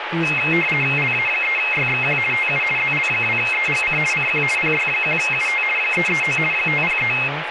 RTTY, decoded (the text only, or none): LA3YXQ TU ZL2EGC CQ PY1UT 339 503